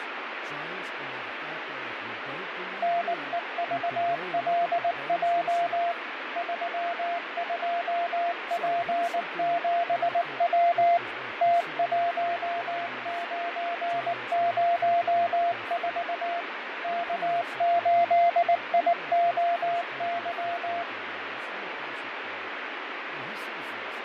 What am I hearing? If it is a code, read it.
Morse code, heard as a keyed tone, machine-sent, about 19 wpm, 690 Hz, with radio static, fading and speech in English. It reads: NEVLJ 32P7W T1904 K8IOY